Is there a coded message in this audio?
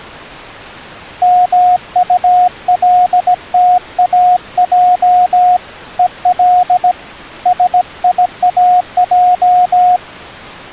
Yes: Morse code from 1.2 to 10.0 s, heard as a keyed tone, hand-sent with a paddle, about 17 wpm, 720 Hz. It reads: MULTAJ EL SIAJ